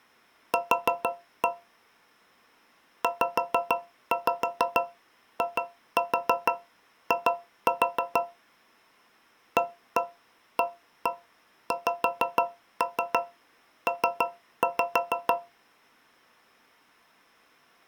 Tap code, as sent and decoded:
4-1 / 5-5 2-4 2-4 / 1-1 1-1 5-3 3-5
Q ZII AAXP

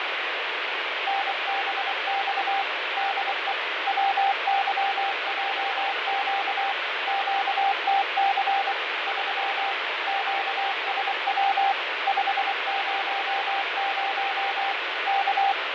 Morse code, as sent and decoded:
-. -... -..- / -.. . / .-- -.-- .--- --.- / --.- - -.-. / ...-- / --.- ... .-- / ..... ----- ----- / -.-
NBX DE WYJQ QTC 3 QSW 500 K

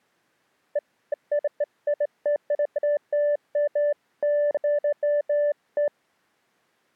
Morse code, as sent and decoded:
none

